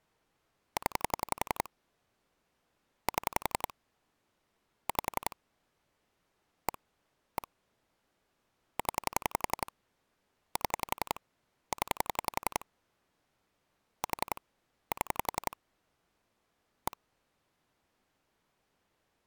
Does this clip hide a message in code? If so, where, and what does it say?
Yes: pulse dialling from 0.8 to 16.9 s, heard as clicks on a phone line, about 11 pulses a second. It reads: 0 7 5 1 1 0 7 0 4 7 1